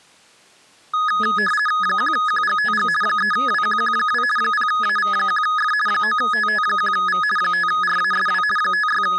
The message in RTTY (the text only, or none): 1QGTG 3WQQ2 0AV1F 9TT1V 5RASW …